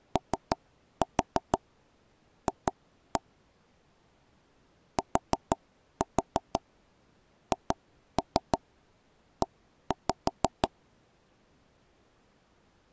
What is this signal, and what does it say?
Tap code, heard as taps on a table, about 6 knocks a second. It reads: OF THE